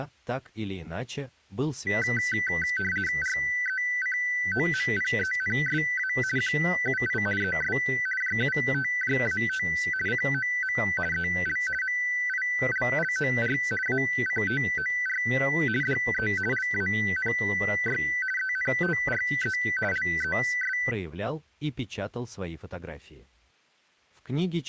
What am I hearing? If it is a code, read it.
RTTY (50 baud, 450 Hz shift), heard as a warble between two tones, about 1750 Hz centre. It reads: RECOMPENSA QUI ES JUTJAT COM EL MILLOR ACTOR DE LANY ENTRE LES